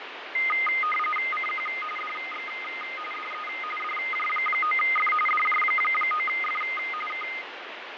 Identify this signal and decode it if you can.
RTTY (45.45 baud, 850 Hz shift), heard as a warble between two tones, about 1650 Hz centre, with radio static and fading. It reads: CQ DX DE DJ9F DJ9F K